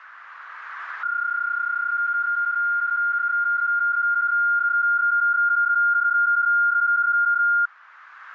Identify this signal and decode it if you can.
PSK31 (31.25 baud), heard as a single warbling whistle, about 1410 Hz, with radio static.